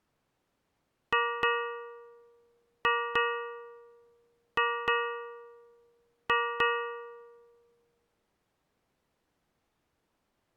Ship's bell, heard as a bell. 8. Eight half-hours of the watch have passed.